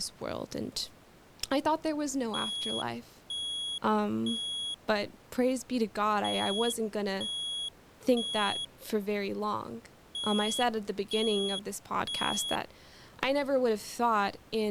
Alarm pattern, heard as an alarm's beeps, played three times, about 3350 Hz, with speech in English. Temporal three. Smoke or fire, evacuate.